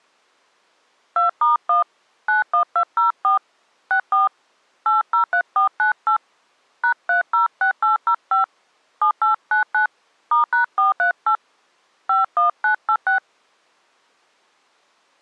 DTMF, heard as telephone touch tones, dialled by hand, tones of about 110 ms. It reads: 2*1 91204 64 803498 #306805 7899 *#438 51986